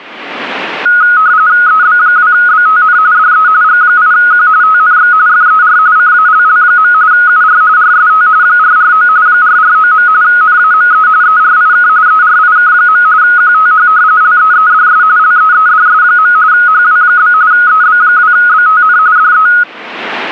RTTY (45.45 baud, 170 Hz shift), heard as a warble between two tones, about 1360 Hz centre. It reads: EB2BTN DE G8Q TNX FER CALL. UR RST 449 449. NAME ERIK ERIK. QTH LEEDS LEEDS. HW? EB2BTN DE